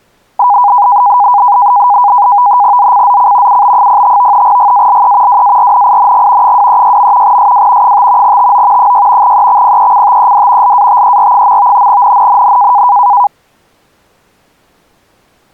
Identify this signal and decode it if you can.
NAVTEX (SITOR-B), 100 baud, 170 Hz shift, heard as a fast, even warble, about 900 Hz centre. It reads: ZCZC UB05 GALE WARNING 236. SW 5 TO 6 EXPECTED LATER. NNNN